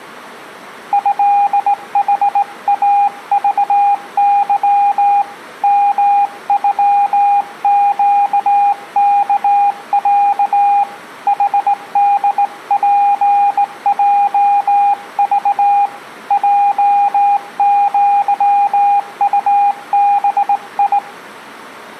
Morse code (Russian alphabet), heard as a keyed tone, hand-sent with a straight key, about 18 wpm, 810 Hz. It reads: ЭХАЖЫ МЮЩКЯ ХДПЙЖ ЙЪУБИ